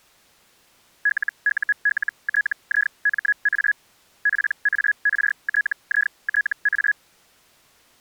Hellschreiber (Feld-Hell, 122.5 baud), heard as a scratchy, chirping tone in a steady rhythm, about 1700 Hz. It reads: LULTIMA PARTITA